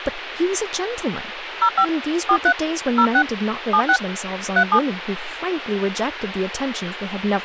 DTMF, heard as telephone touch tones, dialled by hand, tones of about 70 ms, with radio hiss and speech in English. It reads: 05 43 06 76 37